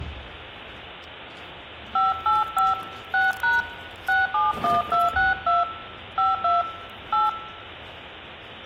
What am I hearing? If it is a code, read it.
DTMF, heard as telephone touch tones, dialled by hand, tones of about 170 ms, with hum and the noise of a crowd indoors. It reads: 585 6# 671262 52 8